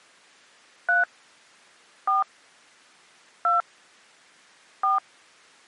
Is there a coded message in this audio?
Yes: DTMF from 0.9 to 5.0 s, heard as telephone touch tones, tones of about 150 ms. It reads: 3 4 2 4